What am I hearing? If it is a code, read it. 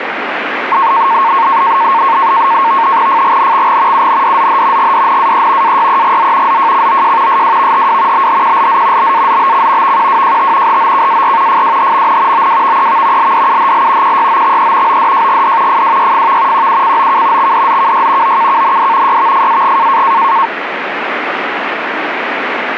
NAVTEX (SITOR-B), 100 baud, 170 Hz shift, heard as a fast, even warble, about 1000 Hz centre, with radio static. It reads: FGNXG UNDZH GDNAE AYEGZ ZJCOJ SWVHW BHQLZ BAZBC VQWJT HOKAR FWHMN OWVEV LDUHL QYOXE ODJGD FWYFV QUCOK XDZKY OKKND YVFAG